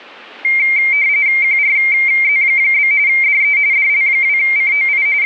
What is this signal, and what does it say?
RTTY (45.45 baud, 170 Hz shift), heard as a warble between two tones, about 2200 Hz centre. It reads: QRZ? DE DL2COI …